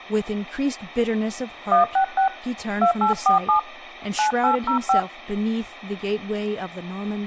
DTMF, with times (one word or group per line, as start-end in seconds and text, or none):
1.7-2.3 166
2.8-3.6 2847
4.2-5.0 9805